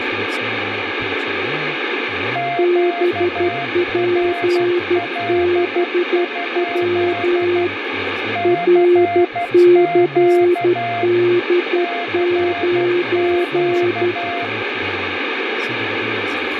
Morse code, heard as two keyed tones, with radio static and speech in Hebrew. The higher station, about 12 wpm, 700 Hz: QRL? CQ CQ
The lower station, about 12 wpm, 350 Hz: BPBW RCD9